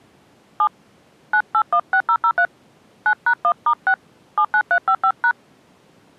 DTMF, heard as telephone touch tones, dialled by hand, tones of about 70 ms. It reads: 7 9816003 9#1*6 79355#